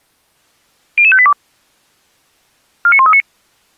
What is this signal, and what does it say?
Five-tone selective call (ZVEI), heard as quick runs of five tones, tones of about 70 ms. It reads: 00582 49139